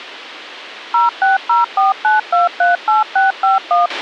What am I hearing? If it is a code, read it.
DTMF, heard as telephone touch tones, dialled by machine, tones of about 150 ms, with a squelch burst at the end. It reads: 06049238651